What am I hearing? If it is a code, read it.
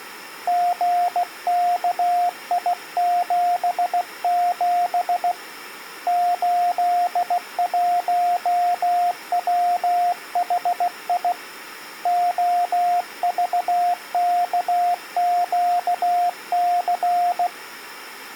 Morse code, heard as a keyed tone, hand-sent with a bug key, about 16 wpm, 710 Hz. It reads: GKI77 81WHI OVKQC